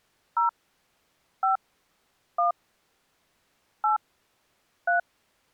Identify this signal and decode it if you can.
DTMF, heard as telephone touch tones, dialled by hand, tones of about 130 ms. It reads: 0 5 1 8 3